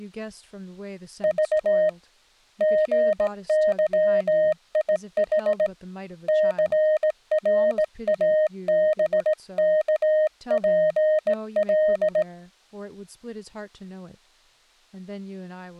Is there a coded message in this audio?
Yes: Morse code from 1.2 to 12.3 s, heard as a keyed tone, hand-sent with a straight key, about 18 wpm, 620 Hz, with speech in English. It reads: V GYIH CRABKPL